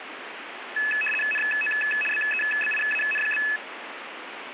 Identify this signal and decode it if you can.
RTTY (75 baud, 850 Hz shift), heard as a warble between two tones, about 2150 Hz centre, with radio static. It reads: NO BEBIAN?